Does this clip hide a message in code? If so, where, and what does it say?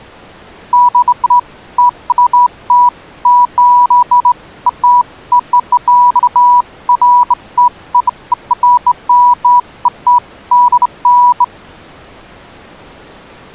No, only beeps of irregular length.